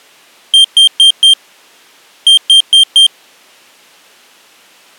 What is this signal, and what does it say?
Beep code, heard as a piezo beeper, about 3150 Hz. 4-4.